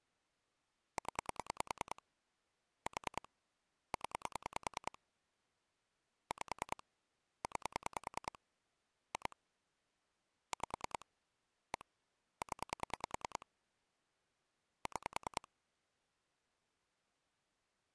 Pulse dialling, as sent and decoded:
10 / 4 / 10 / 5 / 9 / 2 / 5 / 1 / 10 / 6
0 4 0 5 9 2 5 1 0 6

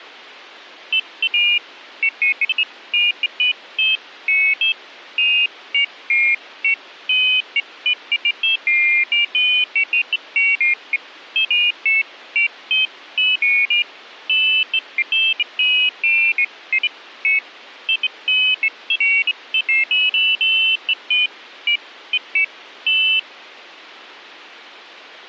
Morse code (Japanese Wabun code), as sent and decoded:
none

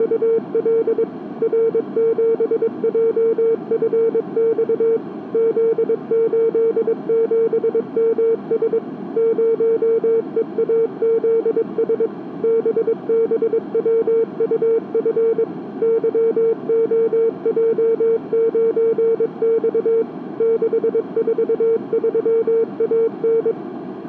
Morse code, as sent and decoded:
… / .-. --... .--- ..-. -..- / --.. ---.. --... -- ... / ----- . .- --.. ... / -... -... .-- ..- ..-. / -.-- --- .--- ----. -..- / -.... ....- ...-- .- -.
… R7JFX Z87MS 0EAZS BBWUF YOJ9X 643AN

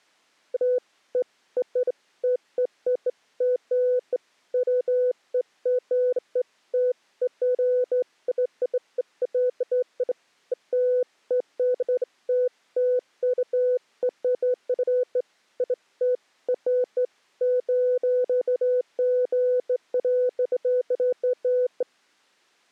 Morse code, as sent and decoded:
none

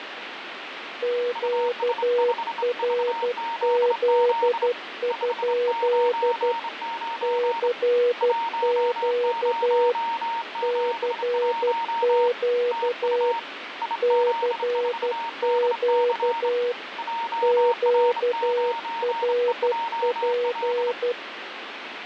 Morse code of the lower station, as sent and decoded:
--.- .-. --.. ..--.. / -.-. --.- / -.-. --.- / -.-. --.- / --.- .-. .--.
QRZ? CQ CQ CQ QRP

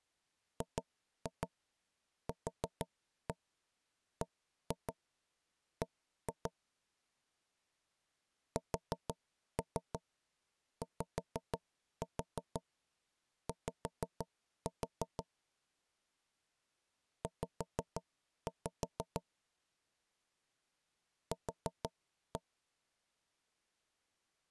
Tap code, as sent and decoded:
2-2 4-1 1-2 1-2 / 4-3 5-4 5-4 / 5-5 / 4-1
GQBB SYY Z Q

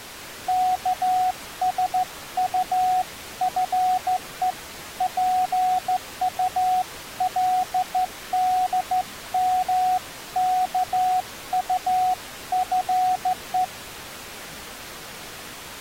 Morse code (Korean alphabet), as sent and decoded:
-.- ... ..- ..-. . / .--. ..- .-.. -.. -- -.- ..- ..-. .
예나 지금이나

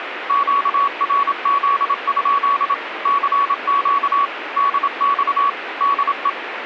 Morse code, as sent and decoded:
--.- .-. --.. ..--.. / -.-. --.- / -.. -..- / -.. .
QRZ? CQ DX DE

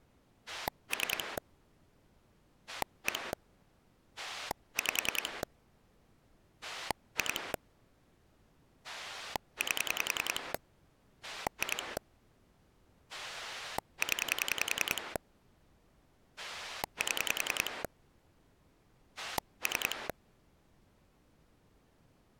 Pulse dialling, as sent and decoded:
3 / 1 / 5 / 2 / 8 / 2 / 10 / 7 / 3
3 1 5 2 8 2 0 7 3

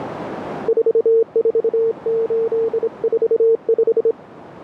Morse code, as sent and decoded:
....- ....- ---.. ....- .....
44845

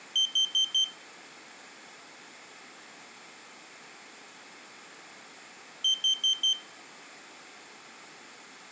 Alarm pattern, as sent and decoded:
4 beeps and a pause
temporal four

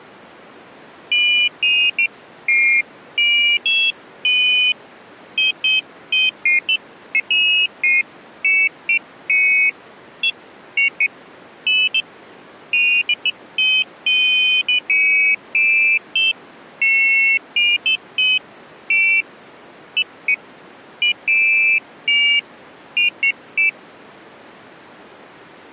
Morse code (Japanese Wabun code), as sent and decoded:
none

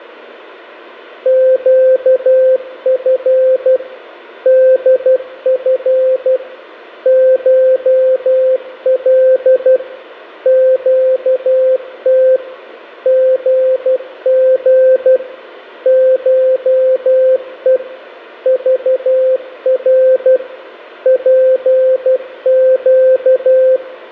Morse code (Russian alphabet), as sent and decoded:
--.- ..-. / -.. ..-. / ---- .-.. / --.- - / --. --. / ---- . / ...- .-. / .--. --.-
ЩФ ДФ ШЛ ЩТ ГГ ШЕ ЖР ПЩ

